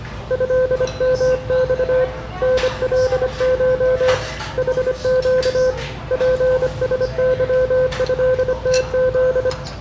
Morse code (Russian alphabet), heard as a keyed tone, hand-sent with a bug key, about 25 wpm, 510 Hz, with room echo and the noise of a restaurant. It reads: ЭМЬ НЛШ ХЩ ПСЫЭТЗ